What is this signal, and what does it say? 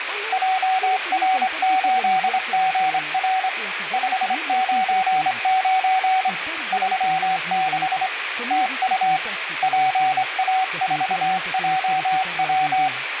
Morse code, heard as a keyed tone, hand-sent with a straight key, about 25 wpm, 750 Hz, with radio static. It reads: JR8GR 599 36 TU PA4JW